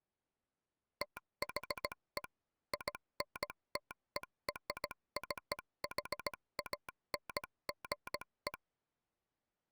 Morse code (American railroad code), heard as a telegraph sounder, machine-sent. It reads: THE INTERCHANGE